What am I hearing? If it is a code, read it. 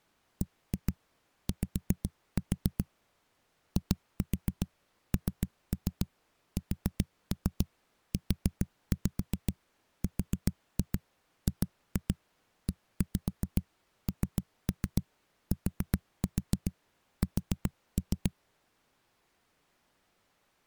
Tap code, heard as knocks on a wall, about 7 knocks a second. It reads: BY INSURGENTS